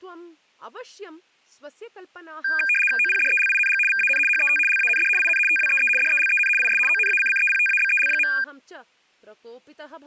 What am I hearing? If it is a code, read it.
RTTY (75 baud, 850 Hz shift), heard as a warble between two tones, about 2000 Hz centre, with speech in Sanskrit. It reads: OPDELING VAN HET LAND IN TWEE DELEN IS ONACCEPTABEL.